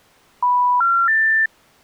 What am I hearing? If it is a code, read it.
Telephone call progress tone (North American plan), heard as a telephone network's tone, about 980, 1370, 1800 Hz. Special information tone.